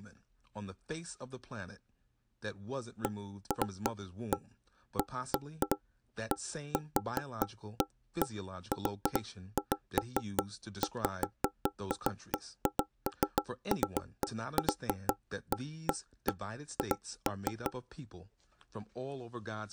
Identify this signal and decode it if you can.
Irregular knocks on wood, with speech in English. There is no code.